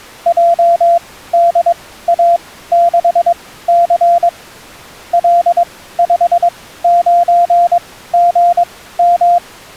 Morse code, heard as a keyed tone, machine-sent, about 22 wpm, spaced as for 15 wpm, 690 Hz. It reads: JDA6C L59GM